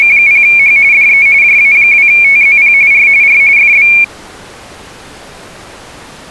RTTY (45.45 baud, 170 Hz shift), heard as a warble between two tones, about 2300 Hz centre. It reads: … DE JA2TZP R R FB